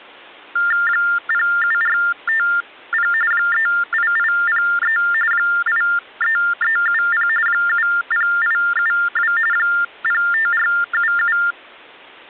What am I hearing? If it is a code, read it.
TTY/TDD text telephone tones (45.45 baud Baudot), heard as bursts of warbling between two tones, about 400 Hz shift, 1600 Hz centre. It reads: 07450 38803 83370 70872 05477